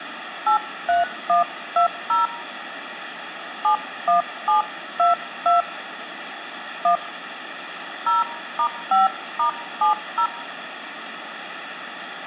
DTMF, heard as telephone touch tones, dialled by hand, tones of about 120 ms, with phone line noise. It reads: 83120 71722 1 0*5*70